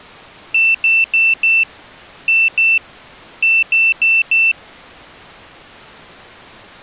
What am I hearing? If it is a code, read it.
Beep code, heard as a piezo beeper, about 2650 Hz. 4-2-4. In Phoenix BIOS tables: unexpected interrupt in protected mode.